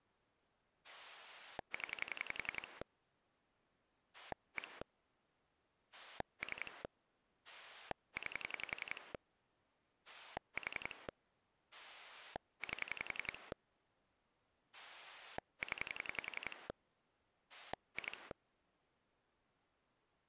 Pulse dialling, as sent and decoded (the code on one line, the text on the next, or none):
10 / 1 / 3 / 9 / 4 / 8 / 10 / 2
0 1 3 9 4 8 0 2